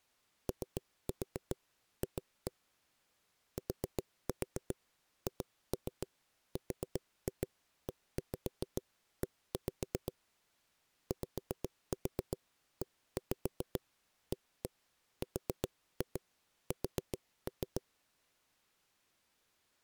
Tap code, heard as knocks on a wall, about 7 knocks a second. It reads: OF THREE YEARS